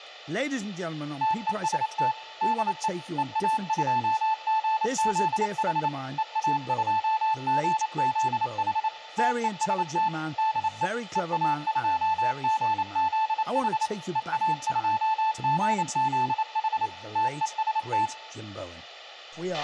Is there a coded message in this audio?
Yes: Morse code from 1.2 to 18.1 s, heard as a keyed tone, machine-sent, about 28 wpm, 880 Hz, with a squelch burst at the end, room echo and speech in English. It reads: TEST DE EA2GZH EA2GZH TEST DE EA2GZH EA2GZH TEST